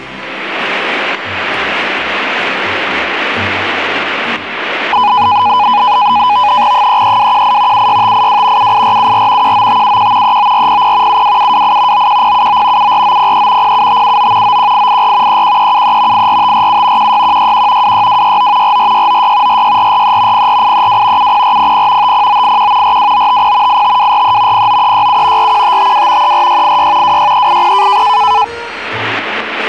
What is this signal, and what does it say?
NAVTEX (SITOR-B), 100 baud, 170 Hz shift, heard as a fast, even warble, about 910 Hz centre, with static crashes. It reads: 33218 76582 78474 19571 39400 72728 91079 74903 07579 91884 31373 84547 16161 26269 44696 46443 04832 70400 50981 42950 85243 09367 41552 34686 26380